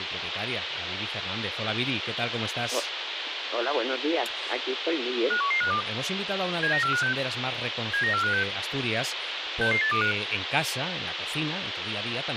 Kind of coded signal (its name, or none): five-tone selective call